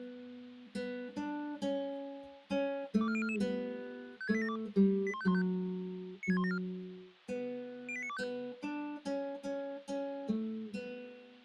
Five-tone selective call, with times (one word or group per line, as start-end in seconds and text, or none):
3.0-3.4 24044
4.2-4.6 56872
5.1-5.4 81515
6.2-6.6 96174
7.9-8.2 08925